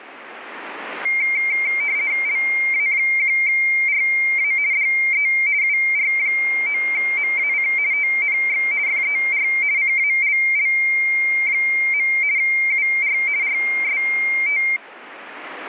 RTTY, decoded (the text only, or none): LA1RA DE UR9MAC TNX FER CALL. UR RST